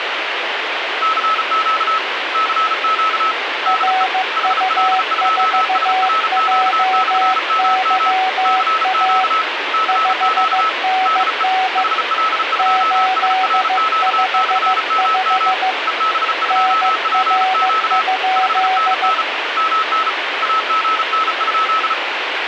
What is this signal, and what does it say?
Morse code, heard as two keyed tones, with radio static. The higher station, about 35 wpm, 1300 Hz: CQ CQ DE HL2SRQ/MM CQ CQ DE HL2SRQ/MM EB2PQ 5NN MN AGN?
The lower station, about 15 wpm, 750 Hz: RU4JYA 5NN 855 NR?